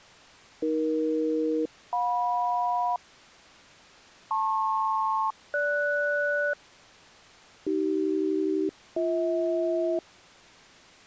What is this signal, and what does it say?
Aircraft SELCAL, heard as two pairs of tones. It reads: AE-JM LP-GS AC-BH